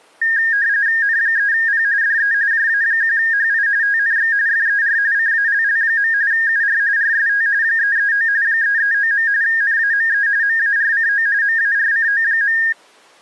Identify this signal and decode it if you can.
RTTY (45.45 baud, 170 Hz shift), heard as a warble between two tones, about 1750 Hz centre. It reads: N3P DE JA1HI TNX FER CALL. UR RST 339 339. NAME MARCO MARCO.